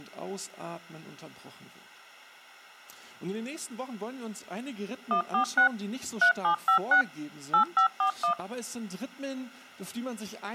DTMF, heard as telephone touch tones, dialled by machine, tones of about 100 ms. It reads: 146 3756 8541